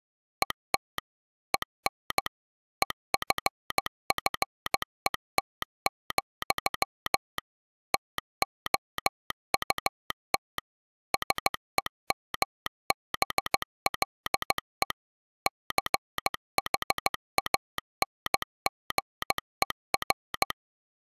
Morse code, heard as a telegraph sounder, machine-sent, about 15 wpm. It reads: ET EN EFFET, TOUT SEMBLE CHANGER